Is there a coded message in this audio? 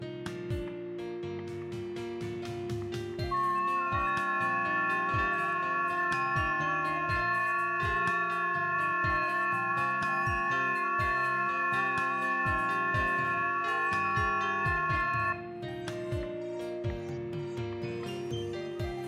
Yes: FT8 (several signals at once) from 3.3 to 15.3 s, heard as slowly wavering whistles, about 6.25 baud, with static crashes, a steady whistle near 350 Hz and room echo.